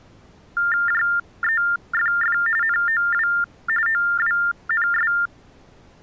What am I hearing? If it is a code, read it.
TTY/TDD text telephone tones (45.45 baud Baudot), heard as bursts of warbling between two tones, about 400 Hz shift, 1600 Hz centre. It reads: JEFF NOW OWNS